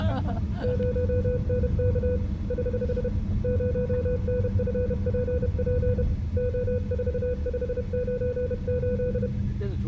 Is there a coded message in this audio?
Yes: Morse code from 0.6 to 9.3 s, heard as a keyed tone, hand-sent with a bug key, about 31 wpm, 500 Hz, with room echo and the noise inside a car. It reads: 0NK <HH> 0NFPP O4598